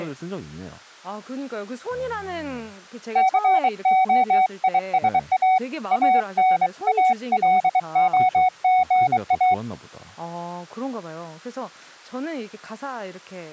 Morse code, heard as a keyed tone, hand-sent with a bug key, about 23 wpm, 750 Hz, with speech in Korean. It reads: COISA ANALOGA